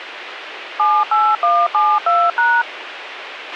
DTMF, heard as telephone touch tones, dialled by machine, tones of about 240 ms, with radio hiss and a squelch burst at the end. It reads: 78172#